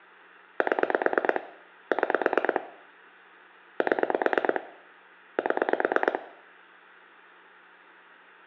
Pulse dialling, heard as clicks on a phone line, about 9 pulses a second, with room echo. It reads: 7 6 7 7